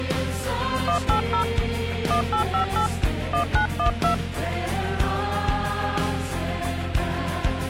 DTMF, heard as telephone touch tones, dialled by hand, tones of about 100 ms. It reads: 180 1858 1912